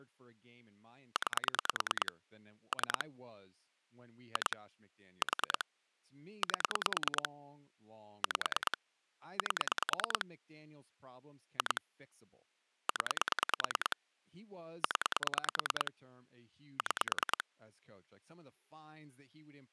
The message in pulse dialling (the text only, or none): 9 3 2 4 8 5 8 2 0 0 6